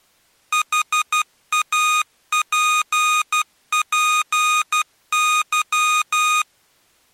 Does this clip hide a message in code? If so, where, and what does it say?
Yes: Morse code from 0.5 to 6.5 s, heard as electronic beeps, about 12 wpm, 1240 Hz. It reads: HAPPY